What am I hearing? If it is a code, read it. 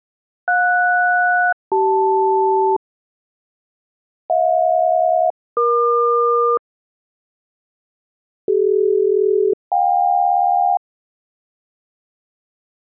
Aircraft SELCAL, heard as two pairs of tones. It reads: JS-CL HJ-EQ CD-JK